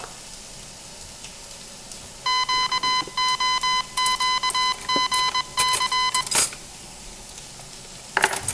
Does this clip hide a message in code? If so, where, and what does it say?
Yes: Morse code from 2.2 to 6.3 s, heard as electronic beeps, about 21 wpm, 1010 Hz, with room echo and the noise of a restaurant. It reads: QOQGC